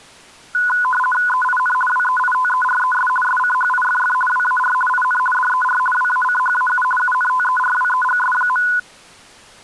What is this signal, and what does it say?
RTTY (50 baud, 450 Hz shift), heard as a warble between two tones, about 1240 Hz centre. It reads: EIN WEITERES SCHIFF WAR IN DER WACHAU UNTERWEGS.